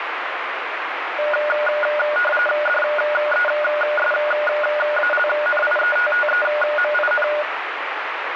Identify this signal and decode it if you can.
RTTY (45.45 baud, 850 Hz shift), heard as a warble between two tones, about 1020 Hz centre, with radio static. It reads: DESALNIETTEMIN